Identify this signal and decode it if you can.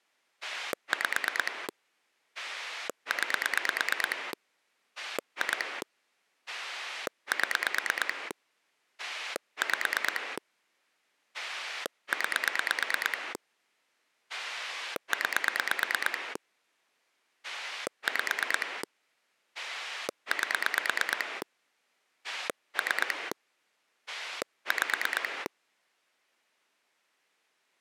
Pulse dialling, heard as a rotary dial, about 9 pulses a second. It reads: 5 9 2 7 5 9 9 5 8 3 5